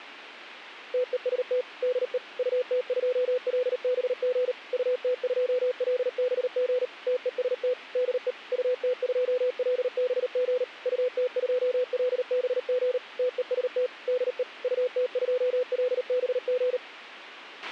Morse code, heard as a keyed tone, machine-sent, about 38 wpm, 500 Hz, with a squelch burst at the end. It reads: TEST DE UT2LBG UT2LBG TEST DE UT2LBG UT2LBG TEST DE UT2LBG